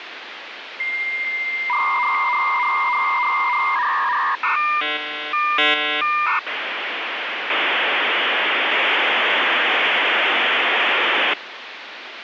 Dial-up modem handshake (V.34 or later), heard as a whistle, warbles, then hiss, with phone line noise.